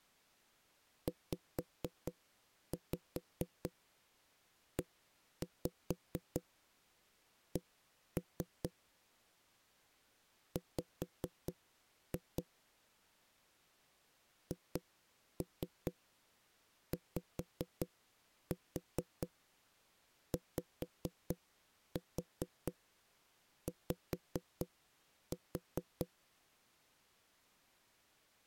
Tap code, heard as knocks on a wall, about 4 knocks a second. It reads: ZEC W HYYY